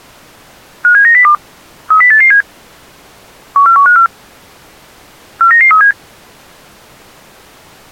Five-tone selective call (CCIR), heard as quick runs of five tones, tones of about 100 ms. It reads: 57902 30887 14154 49937